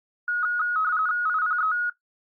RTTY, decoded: IPE

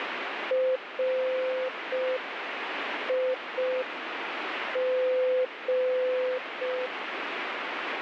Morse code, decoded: RIG

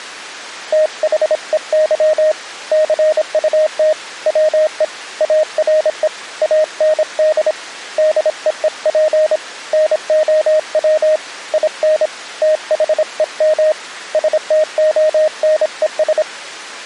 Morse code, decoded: THEY CUT WE ARE AND DEEP NOW IN THEM STONES

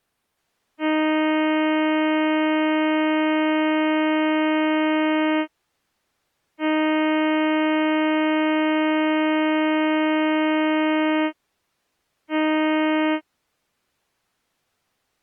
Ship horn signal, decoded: 2 long, 1 short

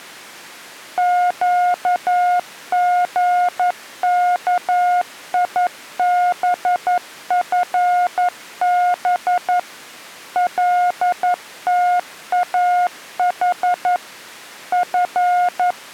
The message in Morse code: QGKIBFB LTAH F

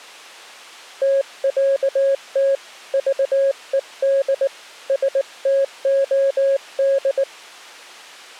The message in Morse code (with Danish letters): TÆT VED STOD

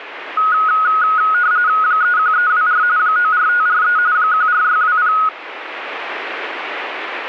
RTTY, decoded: 31324 94543 14620

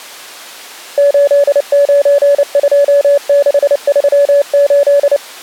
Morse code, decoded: 892638

